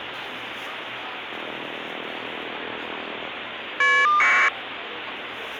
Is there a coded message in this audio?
Yes: caller ID data burst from 1.3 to 4.5 s, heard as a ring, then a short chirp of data, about 1200 baud, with phone line noise and the noise of a crowd indoors.